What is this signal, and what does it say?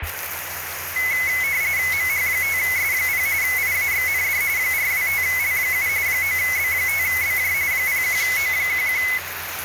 RTTY (45.45 baud, 170 Hz shift), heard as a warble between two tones, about 2100 Hz centre, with radio static and the noise of a restroom. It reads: MH5S0 IAXND 425L7 9B5BJ 01O11